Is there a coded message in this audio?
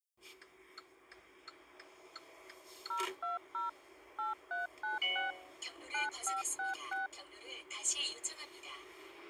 Yes: DTMF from 2.9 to 7.1 s, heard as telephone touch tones, dialled by machine, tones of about 150 ms, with the noise inside a car. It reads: 020 8396 9566